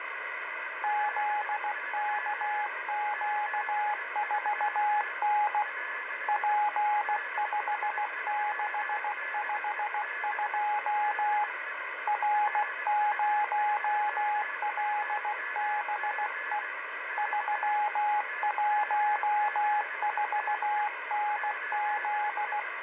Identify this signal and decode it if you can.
Morse code, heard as a keyed tone, hand-sent with a paddle, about 16 wpm, 840 Hz, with radio static and a weaker station near 1720 Hz. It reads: ZKQ4N P5652 R0LBE 314NZ